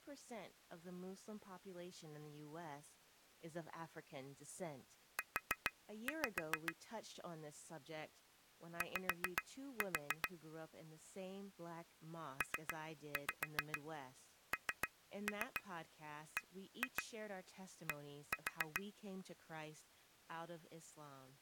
Tap code, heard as taps on glass, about 7 knocks a second, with speech in English. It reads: U Y PNBD